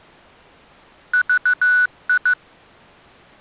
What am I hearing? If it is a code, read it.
Morse code, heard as electronic beeps, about 15 wpm, 1480 Hz. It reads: VI